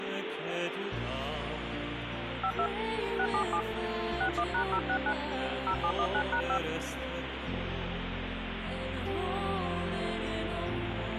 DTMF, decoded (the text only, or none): 52 677 61#069 0719#5